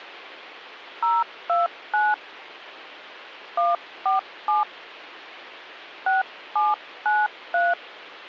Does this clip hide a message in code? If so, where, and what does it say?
Yes: DTMF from 1.0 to 7.7 s, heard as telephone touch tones, dialled by hand, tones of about 160 ms. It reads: 029 147 6793